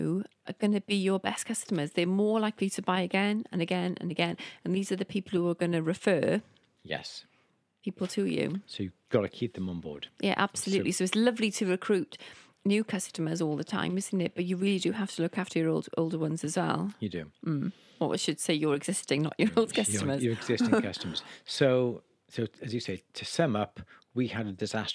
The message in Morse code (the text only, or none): none